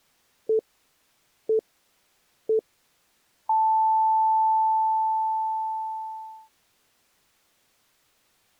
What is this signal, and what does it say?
Radio time signal (three low pips and a long one an octave up, as on NHK), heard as pips.